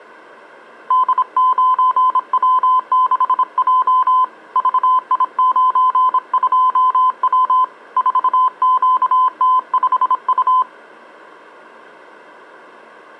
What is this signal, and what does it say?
Morse code, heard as a keyed tone, hand-sent with a bug key, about 26 wpm, 1020 Hz. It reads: D9W6J VI92W 4QT5U